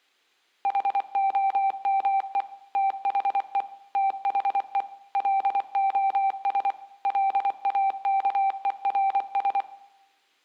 Morse code, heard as a keyed tone, machine-sent, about 24 wpm, 780 Hz, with room echo. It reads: HOME THE THE LOS LAKERS